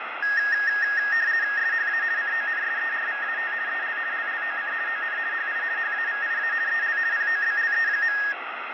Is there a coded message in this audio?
Yes: RTTY (50 baud, 170 Hz shift) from 0.2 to 8.3 s, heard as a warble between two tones, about 1750 Hz centre, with radio static and fading. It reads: SHA CONSERVAT EL LLOC ON HI HAVIA EL POBLE.